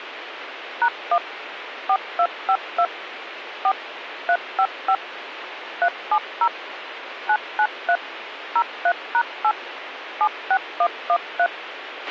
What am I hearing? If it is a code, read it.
DTMF, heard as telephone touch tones, dialled by machine, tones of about 70 ms, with radio hiss and a squelch burst at the end. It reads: #1 4252 4 355 370 993 03#8 76113